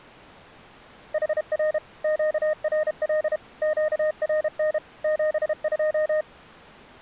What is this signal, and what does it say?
Morse code, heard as a keyed tone, machine-sent, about 32 wpm, 620 Hz. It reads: HR QRL QRN 72